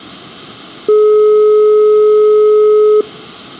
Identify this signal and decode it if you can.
Telephone call progress tone (425 Hz plan, as in most of Europe), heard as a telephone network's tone, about 420 Hz. Dial tone.